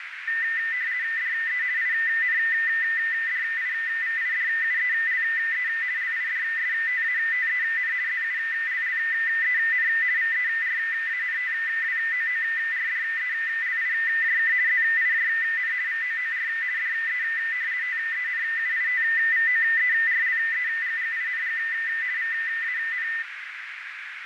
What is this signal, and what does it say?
RTTY (50 baud, 170 Hz shift), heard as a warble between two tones, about 1900 Hz centre, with radio static and a narrow filter. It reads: DE INDIVIDUELE LIDSTATEN ZULLEN VERANTWOORDELIJK ZIJN VOOR DE TENUITVOERLEGGING VAN